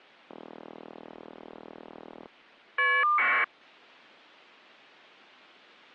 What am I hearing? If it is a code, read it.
Caller ID data burst, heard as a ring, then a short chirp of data, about 1200 baud.